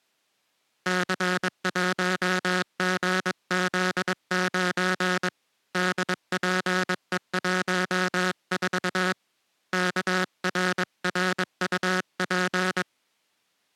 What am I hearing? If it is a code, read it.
Morse code, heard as a buzzer, hand-sent with a paddle, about 22 wpm. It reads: C1GZ9 DPE14 KRRUP